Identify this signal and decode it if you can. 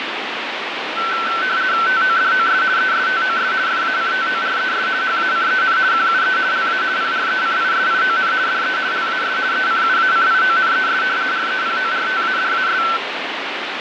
RTTY (50 baud, 170 Hz shift), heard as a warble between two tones, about 1430 Hz centre, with radio static. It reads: TODOS ESTOS FACTORES HACEN QUE LA PRECISION DE LAS ECUACIONES REPORTADAS